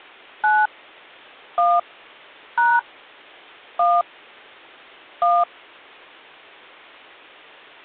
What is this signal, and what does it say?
DTMF, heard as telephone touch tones, dialled by hand, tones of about 220 ms. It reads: 9 1 # 1 1